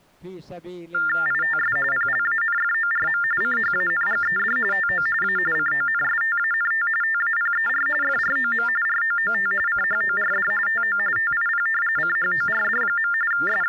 TTY/TDD text telephone tones (45.45 baud Baudot), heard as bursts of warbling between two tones, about 400 Hz shift, 1600 Hz centre. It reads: ITS PLANFORM CHANGED TO A CONSTANT TAPER FROM ROOT CHORD TO TIP CHORD. …